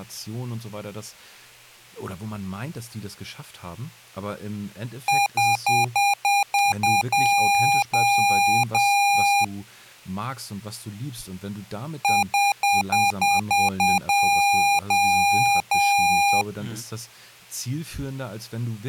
Beep code, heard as beeps from a small speaker, played twice, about 810 Hz, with speech in German. 7 short, 3 long.